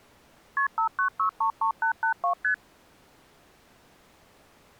Multi-frequency trunk signalling (R1, as on North American trunks), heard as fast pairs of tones, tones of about 100 ms. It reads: KP 59633882 ST